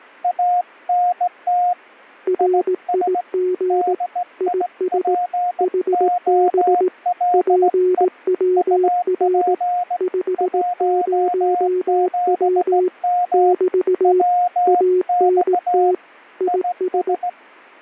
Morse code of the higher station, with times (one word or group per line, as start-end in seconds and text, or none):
0.2-1.7 ANT
2.4-3.2 IS
3.7-8.0 DIPOLE
8.6-10.0 UP
10.4-13.5 17M
14.0-15.9 WX
16.5-17.3 IS